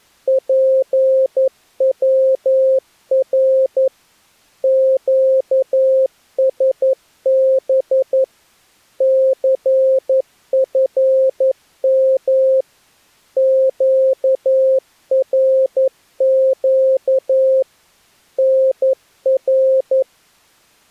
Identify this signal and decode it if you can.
Morse code, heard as a keyed tone, machine-sent, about 11 wpm, 530 Hz. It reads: PWR QSB CFM QRQ NR